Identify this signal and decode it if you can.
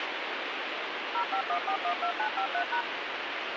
DTMF, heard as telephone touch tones, dialled by machine, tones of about 90 ms, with radio hiss. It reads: 051412953#